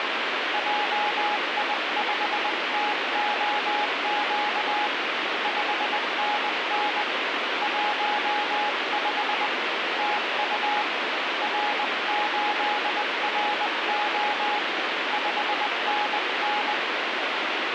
Morse code, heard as a keyed tone, hand-sent with a paddle, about 20 wpm, 840 Hz, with heavy radio static. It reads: JI5TOQ 5NN 15 TU R8RO 5NN